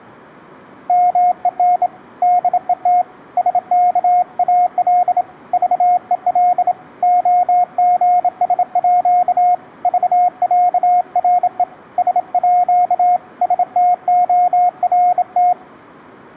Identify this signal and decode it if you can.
Morse code (with Danish letters), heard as a keyed tone, hand-sent with a bug key, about 27 wpm, 720 Hz. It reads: MEN DET SKAL VEL OGSÅ VÆRE SÅ STORT